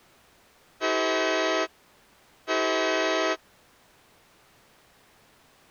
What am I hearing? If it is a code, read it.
Train horn signal, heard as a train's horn. 2 short. On North American railways: a signal is acknowledged.